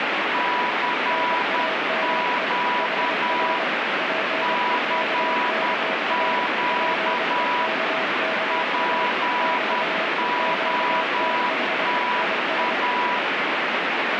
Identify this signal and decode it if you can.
Morse code, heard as two keyed tones, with heavy radio static. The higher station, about 10 wpm, 980 Hz: CQ CQ POTA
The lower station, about 24 wpm, 640 Hz: NAME HR PEKKA PEKKA <BT> QTH IS